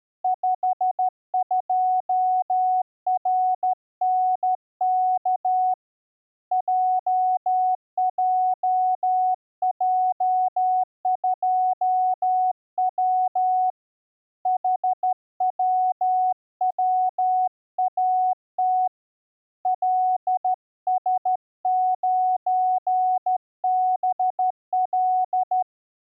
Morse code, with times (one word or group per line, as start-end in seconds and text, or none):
0.2-5.7 52RNK
6.5-13.7 JJJ2W
14.5-18.9 HWWAT
19.7-25.6 LS9BL